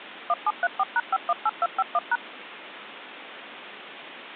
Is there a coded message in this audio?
Yes: DTMF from 0.3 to 2.2 s, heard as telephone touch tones, dialled by machine, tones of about 40 ms, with phone line noise. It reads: 1734#518251#